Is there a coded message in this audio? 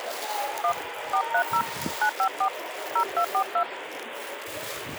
Yes: DTMF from 0.6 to 3.6 s, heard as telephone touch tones, dialled by hand, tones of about 80 ms, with phone line noise and the noise of a residential street. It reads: 1 430 954 0242